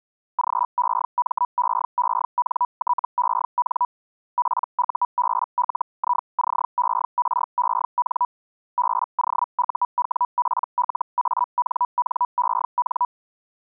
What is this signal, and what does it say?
Hellschreiber (Feld-Hell, 122.5 baud), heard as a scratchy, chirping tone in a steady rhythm, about 980 Hz. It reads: GEMEENTEN PUBLICEREN BOUWPLANNEN